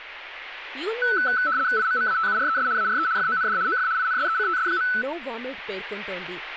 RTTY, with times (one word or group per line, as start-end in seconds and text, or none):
1.8-2.7 IMMATURES
2.8-3.1 ARE
3.2-3.6 FOND
3.7-3.9 OF
4.0-4.9 INSECTS.